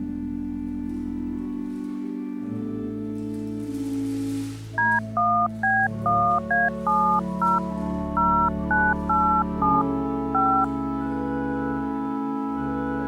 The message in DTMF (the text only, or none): D1B1A70 0987 5